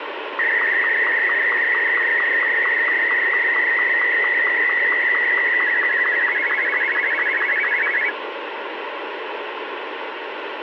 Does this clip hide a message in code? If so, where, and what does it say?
Yes: SSTV (slow-scan television), Martin M2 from 0.4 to 8.1 s, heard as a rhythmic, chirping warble, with radio hiss.